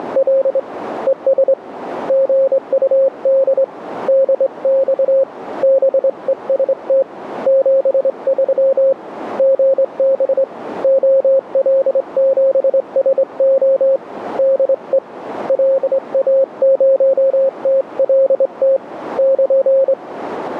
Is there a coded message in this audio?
Yes: Morse code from 0.0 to 20.0 s, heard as a keyed tone, hand-sent with a straight key, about 24 wpm, 540 Hz, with radio static. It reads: … ES GUD DX BEST 73 GB OL7SO DE LA0TLT <KN>